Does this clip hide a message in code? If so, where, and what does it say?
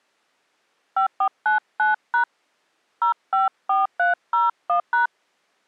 Yes: DTMF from 1.0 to 5.1 s, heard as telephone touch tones, dialled by hand, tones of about 120 ms. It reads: 5499# 054301#